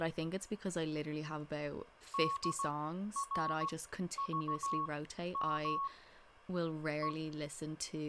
Morse code, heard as a keyed tone, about 16 wpm, spaced as for 11 wpm, 1100 Hz, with speech in English. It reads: DRVM E